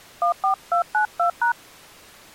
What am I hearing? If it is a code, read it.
DTMF, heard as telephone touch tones, dialled by hand, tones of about 100 ms. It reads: 14292#